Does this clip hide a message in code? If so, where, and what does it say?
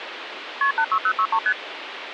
Yes: multi-frequency trunk signalling (R1, as on North American trunks) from 0.6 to 1.5 s, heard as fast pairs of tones, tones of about 70 ms, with phone line noise. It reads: KP 86063 ST